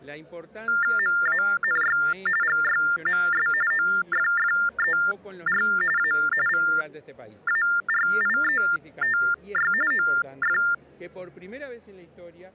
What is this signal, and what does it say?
TTY/TDD text telephone tones (45.45 baud Baudot), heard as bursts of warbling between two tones, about 400 Hz shift, 1600 Hz centre. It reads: MANY GYMS OFFER A VARIETY OF